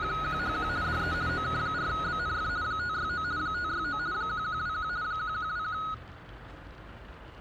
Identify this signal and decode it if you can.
RTTY (50 baud, 170 Hz shift), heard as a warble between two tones, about 1360 Hz centre, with radio static and the noise of a residential street. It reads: … DE OK4BNF 569 569 1121 1121